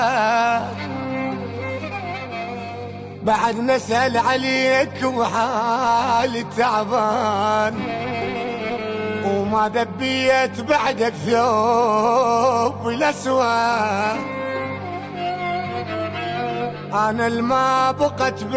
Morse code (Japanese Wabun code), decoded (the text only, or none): none